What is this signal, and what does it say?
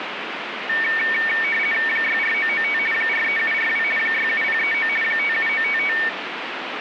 RTTY (50 baud, 450 Hz shift), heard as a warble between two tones, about 2050 Hz centre, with radio static. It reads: 64995 43742 67039 57955